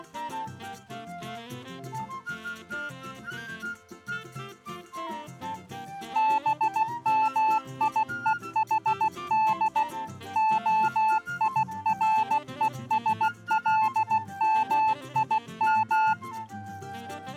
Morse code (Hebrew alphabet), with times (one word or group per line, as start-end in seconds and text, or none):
6.2-9.8 במיוחד
10.4-16.1 הירושלמים